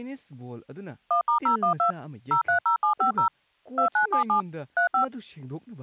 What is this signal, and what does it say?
DTMF, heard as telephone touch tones, dialled by machine, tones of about 110 ms, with speech in Manipuri. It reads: 1*012 030750 2977 35